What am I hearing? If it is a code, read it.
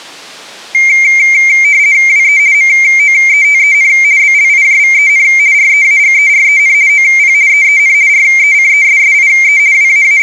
RTTY (50 baud, 170 Hz shift), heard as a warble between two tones, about 2200 Hz centre. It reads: WE MOETEN BLIJVEN REAGEREN OP EEN RECESSIE …